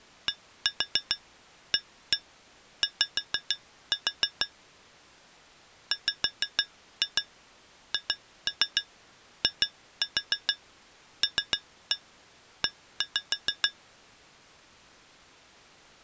Tap code, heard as taps on glass, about 6 knocks a second. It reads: DAY WHILE